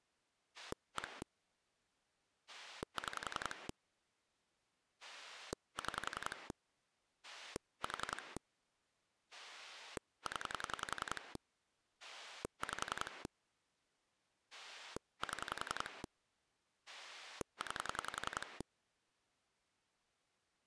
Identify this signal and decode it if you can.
Pulse dialling, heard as a rotary dial, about 10 pulses a second. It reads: 1 6 6 4 0 5 7 9